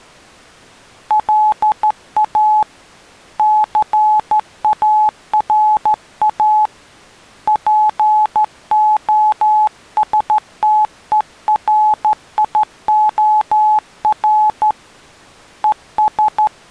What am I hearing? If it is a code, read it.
Morse code, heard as a keyed tone, hand-sent with a straight key, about 13 wpm, 850 Hz. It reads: LA CARA POSTERIOR ES